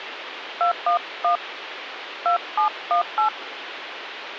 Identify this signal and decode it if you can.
DTMF, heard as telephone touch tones, dialled by hand, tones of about 110 ms, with phone line noise. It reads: 211 2718